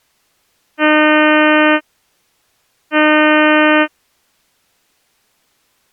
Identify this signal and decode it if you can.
Ship horn signal, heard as a ship's horn, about 300 Hz. 2 short. At sea: I am altering course to port.